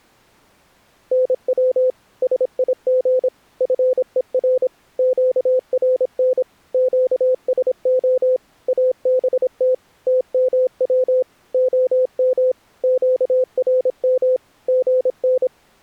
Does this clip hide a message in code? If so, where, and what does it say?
Yes: Morse code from 1.1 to 15.5 s, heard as a keyed tone, machine-sent, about 26 wpm, 510 Hz. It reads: NW SIG FER QRN QSO ABT TMW OM QRM GN